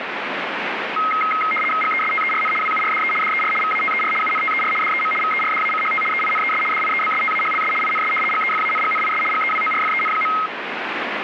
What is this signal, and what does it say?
RTTY (75 baud, 850 Hz shift), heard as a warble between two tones, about 1700 Hz centre, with radio static. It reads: GESTERN WURDE DER VATER UNTER DEM VERDACHT EINES DIEBSTAHLS INS GEFANGNIS GEWORFEN.